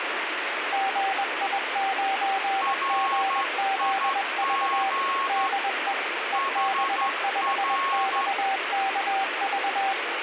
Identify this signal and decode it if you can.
Morse code, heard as two keyed tones, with radio static. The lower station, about 21 wpm, 780 Hz: GI9GZV DE EB5XKV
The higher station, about 12 wpm, 1090 Hz: RIG HR